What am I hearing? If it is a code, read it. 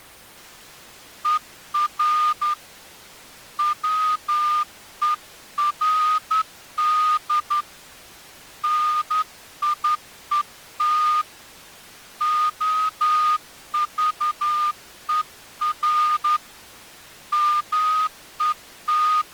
Morse code, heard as a whistle, hand-sent with a straight key, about 11 wpm. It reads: ER WERD NIET OVER …